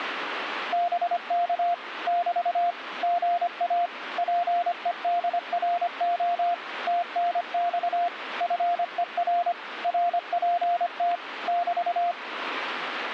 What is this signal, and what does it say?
Morse code, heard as a keyed tone, machine-sent, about 25 wpm, 700 Hz, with radio static. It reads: BK <BT> GA PEDRO TNX FER RPT <BT>